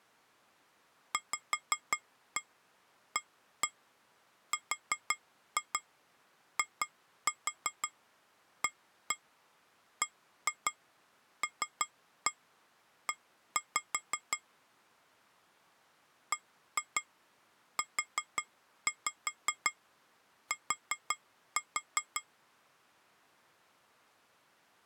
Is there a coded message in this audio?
Yes: tap code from 1.1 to 22.3 s, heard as taps on glass, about 5 knocks a second. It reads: VARIABLE BUT